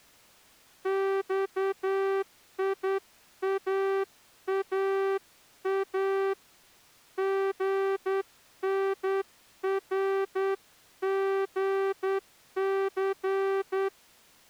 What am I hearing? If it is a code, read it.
Morse code (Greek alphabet), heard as a horn, hand-sent with a straight key, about 9 wpm. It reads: ΞΙΑΑΑ ΓΝΡΓΘ